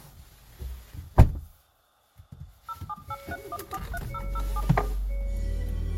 DTMF, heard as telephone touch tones, dialled by machine, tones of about 50 ms, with room echo and the noise inside a car. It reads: 07831430077